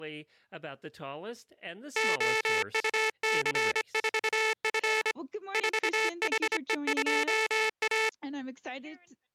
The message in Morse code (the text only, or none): OUC4F 4HE2A